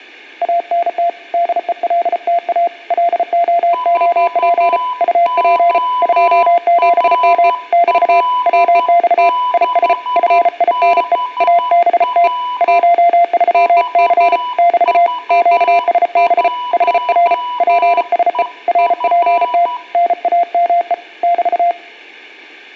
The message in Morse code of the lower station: ANT DELTA LOOP UP 27M <BT> WX IS FINE ABT 13C <BT> QSB HR PSE RPT NAME <BT>

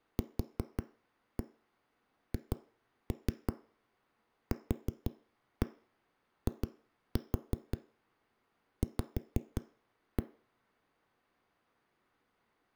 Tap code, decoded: QHQIV

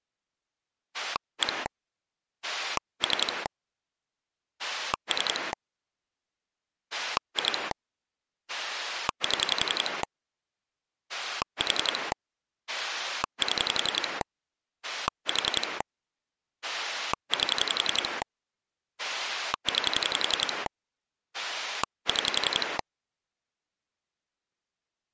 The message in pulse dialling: 1 3 3 2 7 4 7 4 8 9 6

